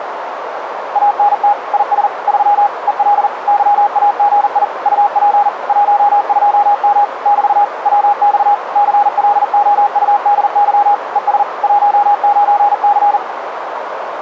Morse code, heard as a keyed tone, machine-sent, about 40 wpm, 820 Hz, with radio static and a narrow filter. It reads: ANT IS 3 EL YAGI UP 12M <BT> WX CLOUDY ES 19C